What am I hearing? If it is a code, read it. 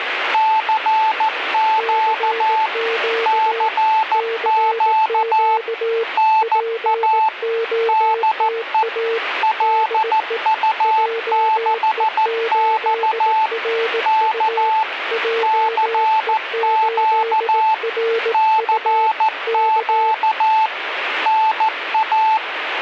Morse code, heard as two keyed tones, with radio static. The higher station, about 14 wpm, 880 Hz: CQ CQ NA DE LU6X K CQ CQ NA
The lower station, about 18 wpm, 460 Hz: CQ CQ POTA DE JE8RU JE8RU K